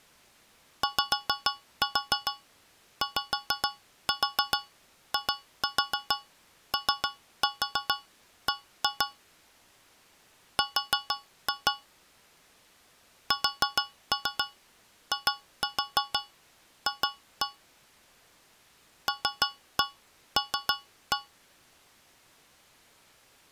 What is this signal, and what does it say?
Tap code, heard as taps on a metal pipe, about 6 knocks a second. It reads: YYIOB R SIF LL